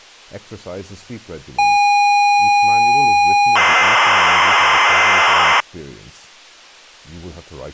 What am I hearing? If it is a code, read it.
ZX Spectrum tape loading, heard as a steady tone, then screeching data, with speech in English.